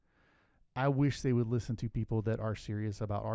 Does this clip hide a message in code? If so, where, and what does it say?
No, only speech in English.